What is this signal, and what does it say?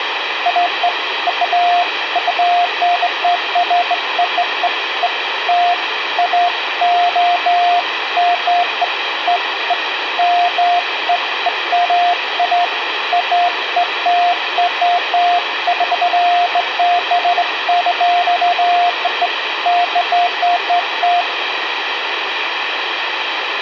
Beeps of irregular length, with phone line noise and room echo. There is no code.